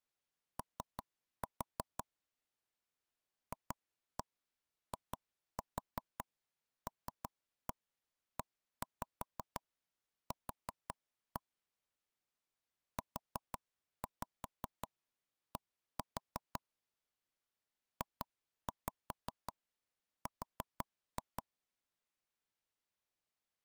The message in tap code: O FILEQ UD JR

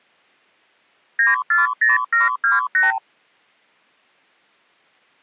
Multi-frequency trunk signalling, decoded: 940728

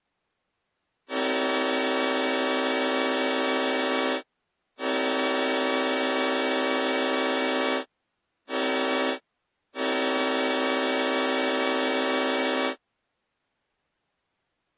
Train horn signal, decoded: 2 long, 1 short, 1 long

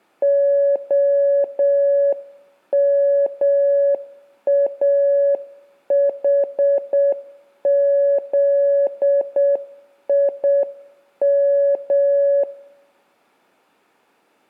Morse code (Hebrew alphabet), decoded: המאחזים

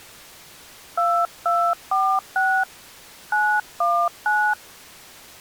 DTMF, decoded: 2246 919

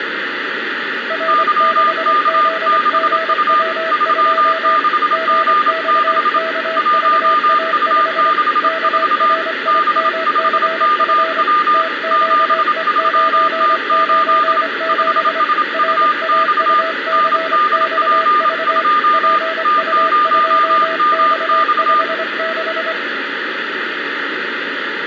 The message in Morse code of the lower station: R6ZGW2 GXKVA5 KRIMCF TQE997 RAUCXV PU2X56

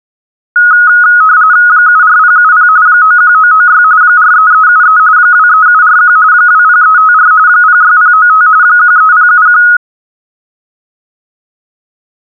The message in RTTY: 74070 91996 43373 23741 20354 06095 13071

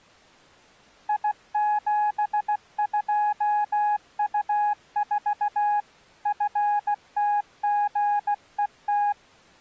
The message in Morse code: I72U4 FTGET

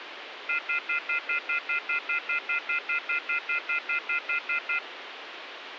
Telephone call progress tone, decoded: off-hook warning tone

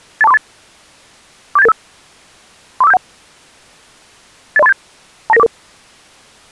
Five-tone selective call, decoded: 82438 47885 34571 80387 29944

